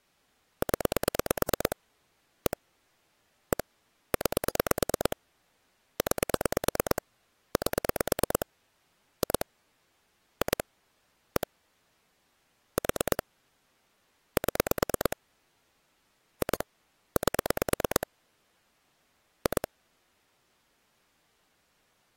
Pulse dialling, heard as clicks on a phone line, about 9 pulses a second. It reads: 0 1 1 9 9 8 2 2 1 4 7 2 8 2